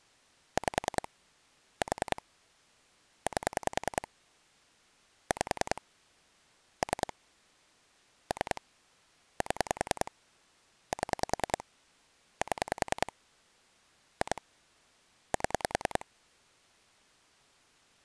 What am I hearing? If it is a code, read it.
Pulse dialling, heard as clicks on a phone line, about 10 pulses a second. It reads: 5 4 8 5 3 3 7 7 7 2 7